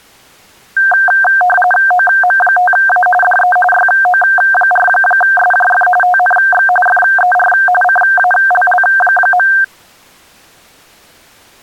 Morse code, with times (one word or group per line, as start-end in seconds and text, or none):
none